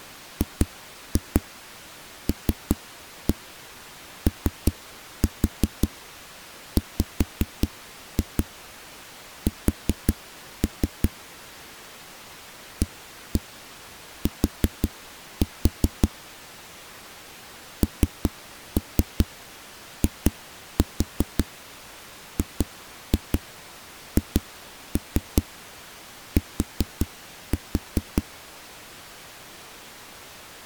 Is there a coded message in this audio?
Yes: tap code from 0.4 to 28.3 s, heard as knocks on a wall, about 5 knocks a second. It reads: GLOWS AT NIGHT